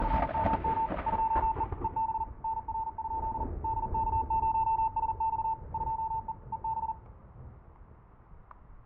Morse code, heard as a keyed tone, machine-sent, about 40 wpm, 890 Hz, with static crashes and room echo. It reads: … 2E EB NR? DK0SX 2E EB